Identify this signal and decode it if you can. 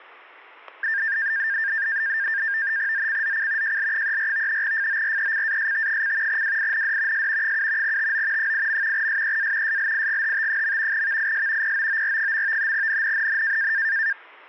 NAVTEX (SITOR-B), 100 baud, 170 Hz shift, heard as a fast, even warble, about 1700 Hz centre, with static crashes. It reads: ZCZC JL34 FORECAST: WIND S 7 TO 8. SEA SLIGHT. VIS POOR. NNNN